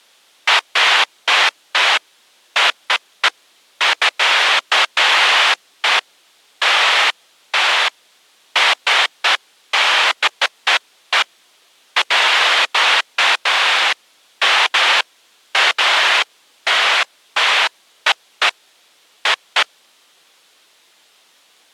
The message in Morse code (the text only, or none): none